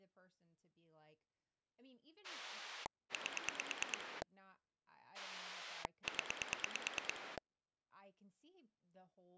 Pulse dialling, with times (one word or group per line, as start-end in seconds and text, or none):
2.2-4.2 8
5.1-7.4 0